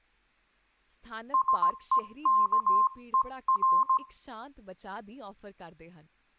Morse code, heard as a keyed tone, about 17 wpm, 1050 Hz, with room echo and speech in Punjabi. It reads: SEKER